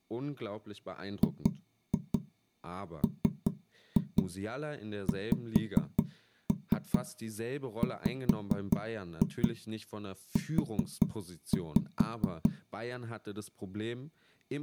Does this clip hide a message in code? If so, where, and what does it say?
Yes: tap code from 1.2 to 12.5 s, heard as knocks on wood, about 4 knocks a second, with speech in German. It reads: GMXWU